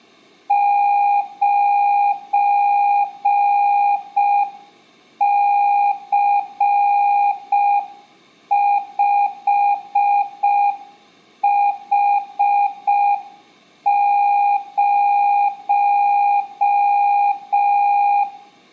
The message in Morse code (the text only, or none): 9C5H0